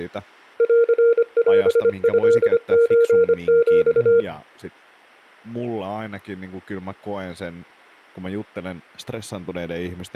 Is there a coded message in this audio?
Yes: Morse code (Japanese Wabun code) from 0.5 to 4.3 s, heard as a keyed tone, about 25 wpm, 470 Hz, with speech in Finnish. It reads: ンオトソヒ